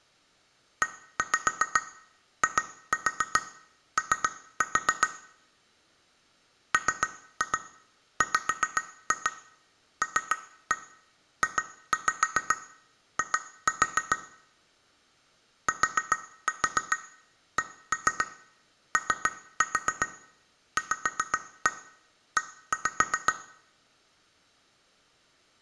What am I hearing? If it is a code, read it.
Tap code, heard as taps on glass, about 7 knocks a second, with room echo. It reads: EIO MWLJI TCOVE